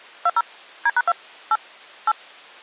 DTMF, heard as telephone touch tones, dialled by machine, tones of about 40 ms. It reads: 20 D#2 8 8